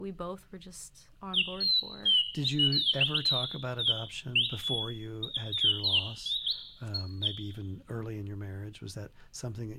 Bird-like chirps, with room echo and speech in English. There is no code.